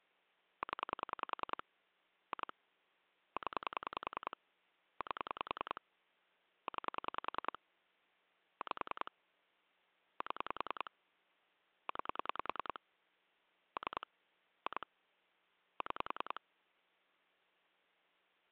Pulse dialling, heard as clicks on a phone line, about 10 pulses a second. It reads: 0 2 0 8 9 5 7 9 3 2 6